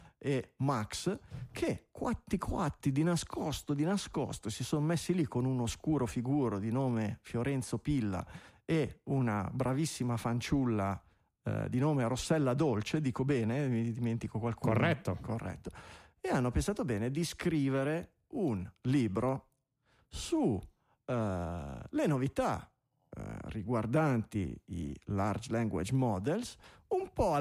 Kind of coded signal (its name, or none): none